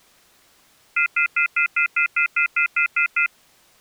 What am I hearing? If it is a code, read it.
Telephone call progress tone (North American plan), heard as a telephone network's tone, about 1400, 2050, 2450, 2600 Hz, 0.1 s on and 0.1 s off. Off-hook warning tone.